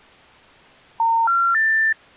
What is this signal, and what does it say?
Telephone call progress tone (North American plan), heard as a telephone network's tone, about 910, 1370, 1800 Hz. Special information tone.